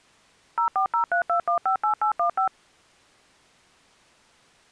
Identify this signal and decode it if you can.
DTMF, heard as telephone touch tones, dialled by machine, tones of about 100 ms. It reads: 04032158815